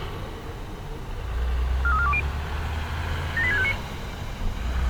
Five-tone selective call (ZVEI), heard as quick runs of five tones, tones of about 70 ms, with street noise. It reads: 43420 78659